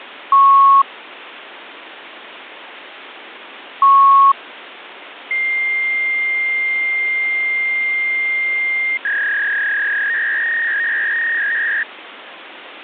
Fax machine handshake, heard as beeps, a long tone and a warble, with phone line noise.